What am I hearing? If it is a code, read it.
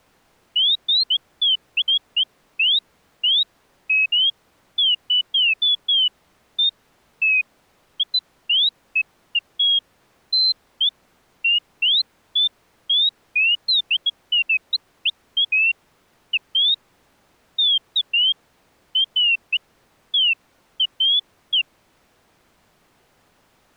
Bird-like chirps. There is no code.